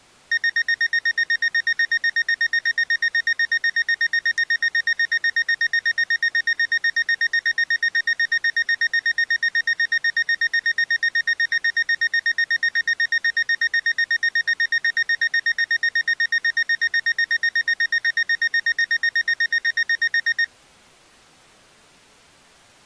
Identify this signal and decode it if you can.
Evenly repeated beeps. There is no code.